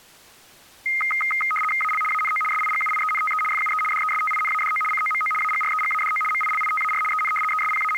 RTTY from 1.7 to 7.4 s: AL ANO SIGUIENTE FUE DESTINADO COMO AGREGADO MILITAR EN

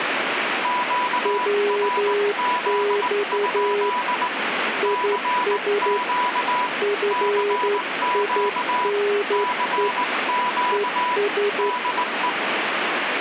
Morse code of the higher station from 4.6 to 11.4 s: CQ CQ CQ

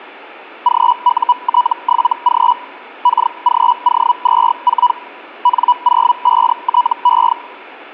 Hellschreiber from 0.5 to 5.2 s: GUT7G KGO24

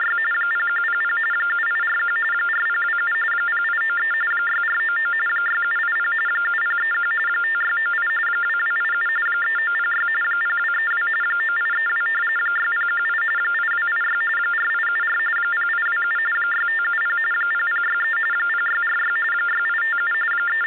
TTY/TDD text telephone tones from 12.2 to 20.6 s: 6018 8286 4874 0827 6570 0063 0646 6857 …

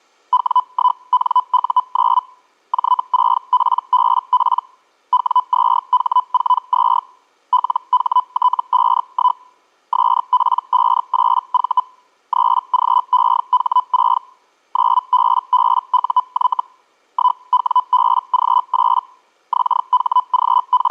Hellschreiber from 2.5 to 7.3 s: J6PBP W2H42

